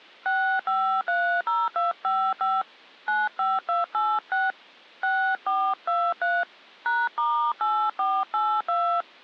DTMF, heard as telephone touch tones, dialled by hand, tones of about 250 ms. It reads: 6530255 95286 6423 #*8482